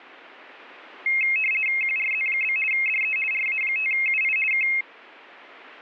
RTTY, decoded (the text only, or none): QRZ? DE RA5UI K